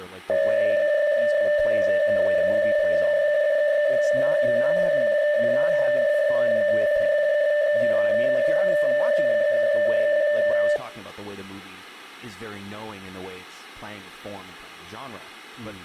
PSK63 (62.5 baud), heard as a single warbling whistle, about 590 Hz, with room echo and speech in English.